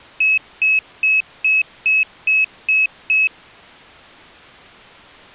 Beep code, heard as a piezo beeper, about 2600 Hz. 8 short. In AMI BIOS tables: display memory failure; in Dell tables: LCD failure.